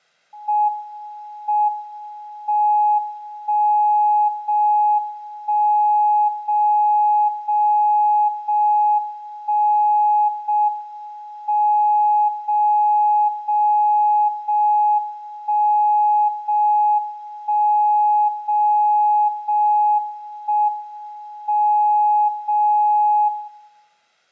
Radio time signal (JJY), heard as a tone whose level steps once a second, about 840 Hz, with room echo. The time is 19:52 Japan time. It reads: M M 1 0 1 0 0 0 1 0 M 0 0 0 1 0 1 0 0 1 M 0 0